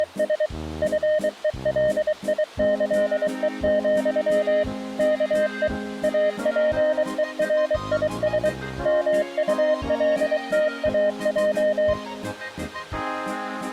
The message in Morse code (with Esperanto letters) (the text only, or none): … FELIĈE, KE APERIS MULTAJ